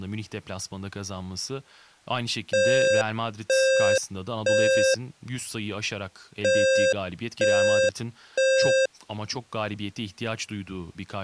Alarm pattern, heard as an alarm's beeps, played twice, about 530 Hz, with speech in Turkish. Temporal three. Smoke or fire, evacuate.